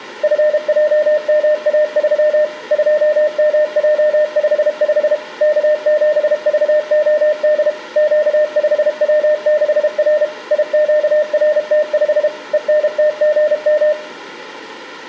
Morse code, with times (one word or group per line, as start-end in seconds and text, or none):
0.2-2.4 FJMA3
2.7-5.1 2MJ55
5.4-7.7 K7VOD
8.0-10.2 Q5W6R
10.5-12.3 IQRT5
12.5-13.9 ENTGM